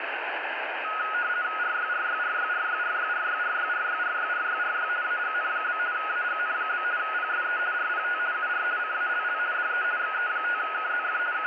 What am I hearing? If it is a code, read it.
RTTY (50 baud, 170 Hz shift), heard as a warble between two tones, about 1360 Hz centre, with radio static. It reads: RYRYRYRYRYRYRYRYRYRYRY AGN? AGN? PSE RPT UR CALL DE XE5KZF …